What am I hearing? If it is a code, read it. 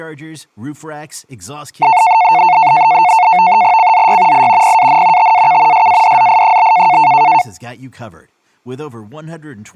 NAVTEX (SITOR-B), 100 baud, 170 Hz shift, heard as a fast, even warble, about 810 Hz centre, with speech in English. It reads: CZY I PAN TAK SADZI?